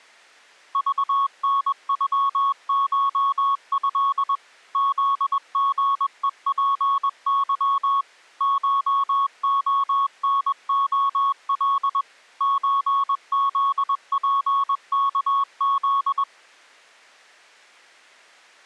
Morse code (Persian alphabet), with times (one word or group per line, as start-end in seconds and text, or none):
0.8-4.4 ذنغشض
4.8-8.0 زژهپظ
8.4-12.0 شعنعل
12.4-16.2 چزپکز